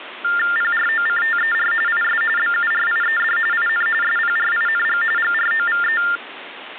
TTY/TDD text telephone tones (45.45 baud Baudot), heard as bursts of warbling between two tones, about 400 Hz shift, 1600 Hz centre, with phone line noise. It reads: PROCTER IS BURIED IN SPRING GROVE